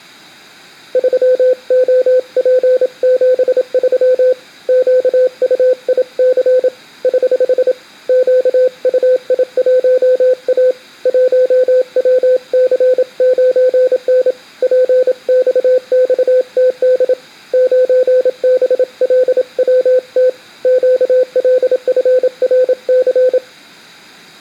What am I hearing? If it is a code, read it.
Morse code, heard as a keyed tone, hand-sent with a paddle, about 27 wpm, 510 Hz. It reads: 3OP73 QUIC <HH> QUI1A 1WC9N PXXTD 9BLWT QLFRC